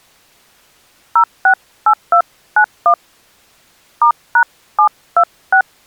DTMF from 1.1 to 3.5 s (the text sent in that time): 068291